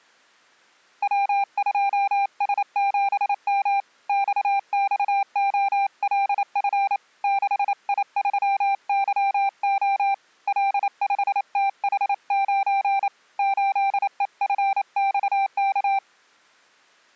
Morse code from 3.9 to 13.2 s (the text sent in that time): XXOLF 6I3YO L5TH9